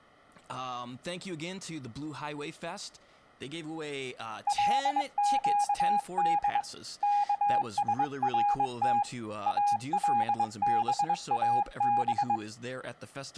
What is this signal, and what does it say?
Morse code (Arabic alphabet), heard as a keyed tone, hand-sent with a straight key, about 22 wpm, 820 Hz, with speech in English. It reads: لقد كسرت الباب